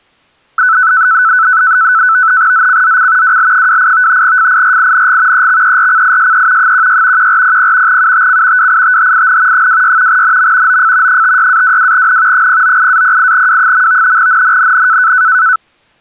NAVTEX (SITOR-B), 100 baud, 170 Hz shift, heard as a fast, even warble, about 1410 Hz centre. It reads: ZCZC WL28 FIRING EXERCISE 16 1400 UTC WITHIN 26 NM OF 56-22N 098-08W. NNNN